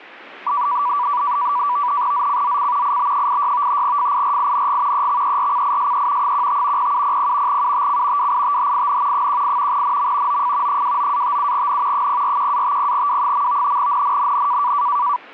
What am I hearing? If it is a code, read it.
NAVTEX (SITOR-B), 100 baud, 170 Hz shift, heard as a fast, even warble, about 1070 Hz centre. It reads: ZCZC IB86 FIRING EXERCISE 15 0700 UTC WITHIN 18 NM OF 29-57N 041-50W. NNNN